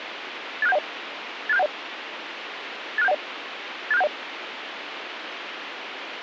Five-tone selective call (EIA), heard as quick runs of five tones, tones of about 30 ms, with radio hiss. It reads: 86710 86710 86710 86710